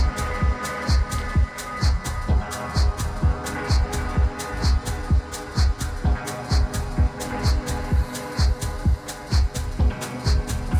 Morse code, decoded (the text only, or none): none